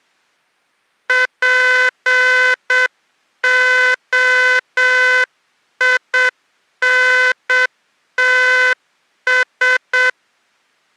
Morse code, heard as a buzzer, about 7 wpm. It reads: POINTS